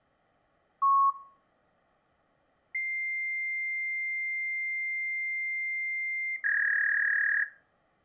Fax machine handshake, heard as a long tone and a warble, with room echo.